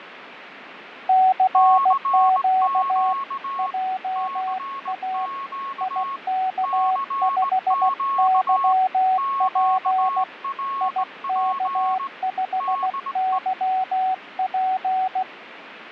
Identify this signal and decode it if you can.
Morse code, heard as two keyed tones, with radio static and fading. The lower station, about 16 wpm, 750 Hz: CQ JA IK5YP IK5YP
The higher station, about 19 wpm, 1100 Hz: CQ CQ CQ QRP DE